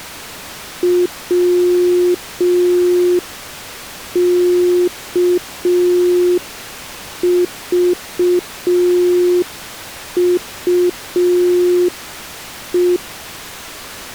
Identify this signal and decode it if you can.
Morse code, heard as a keyed tone, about 5 wpm, 360 Hz. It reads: WKVUE